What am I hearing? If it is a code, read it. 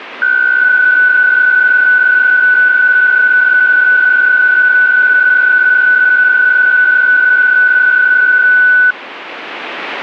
PSK63 (62.5 baud), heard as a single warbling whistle, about 1490 Hz.